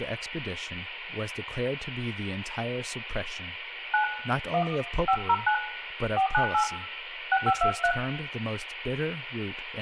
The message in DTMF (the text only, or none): 9 1 509 498 6523